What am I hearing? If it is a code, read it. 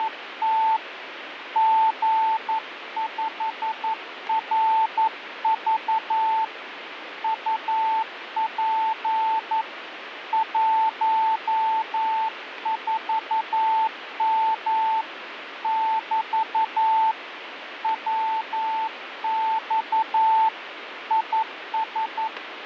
Morse code, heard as a keyed tone, hand-sent with a paddle, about 11 wpm, 890 Hz, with radio static. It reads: … G5RV UP 14M <BT> WX IS